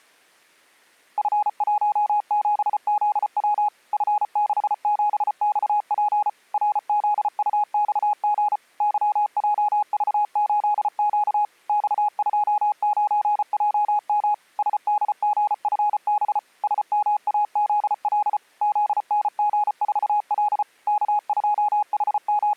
Morse code, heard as a keyed tone, machine-sent, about 34 wpm, 830 Hz. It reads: F17ZW F67XP RZUXG YJV8Q X29JM SDGFB SMAZL ZNG4L …